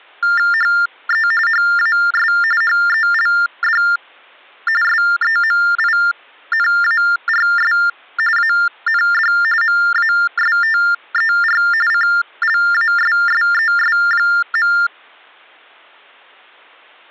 TTY/TDD text telephone tones (45.45 baud Baudot), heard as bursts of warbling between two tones, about 400 Hz shift, 1600 Hz centre. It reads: HE HAS HELD SEMINARS AND MASTER CLASSES.